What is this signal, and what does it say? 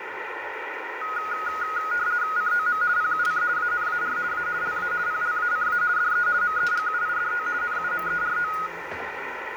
RTTY (50 baud, 170 Hz shift), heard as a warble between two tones, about 1350 Hz centre, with radio static, room echo and the noise of a restaurant. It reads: COM PUC ANAR A LA PLACA DE MEGUIDO NUMERO